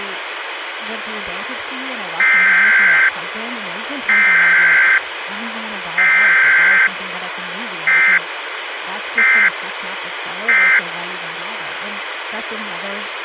Emergency Alert System (SAME) tones (header bursts, then end-of-message bursts), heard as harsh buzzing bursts, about 520.83 baud, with radio hiss and speech in English.